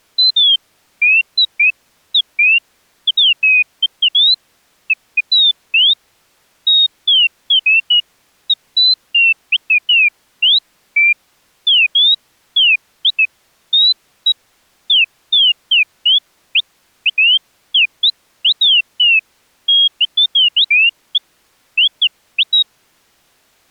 Bird-like chirps. There is no code.